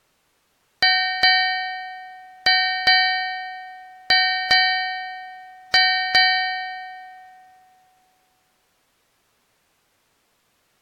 Ship's bell, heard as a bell. 8. Eight half-hours of the watch have passed.